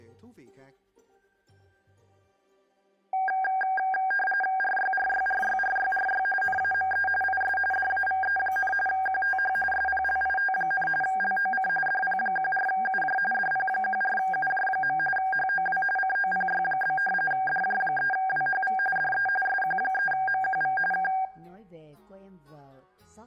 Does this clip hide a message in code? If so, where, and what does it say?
Yes: RTTY (45.45 baud, 850 Hz shift) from 3.1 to 21.3 s, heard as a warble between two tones, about 1180 Hz centre. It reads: RYRYRYRYRY NAME IS DAVE, QTH SPLIT, LOC DP14UJ DP14UJ. HOW COPY? DJ3WHV DE SQ3MQV K